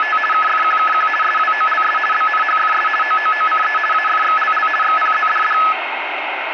RTTY (50 baud, 450 Hz shift), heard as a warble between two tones, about 1500 Hz centre, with radio static. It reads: … KFQKQ SWOLS BNHFS OOOCE AFXLL XPZDD